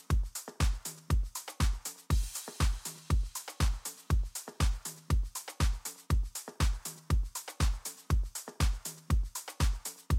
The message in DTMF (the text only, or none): none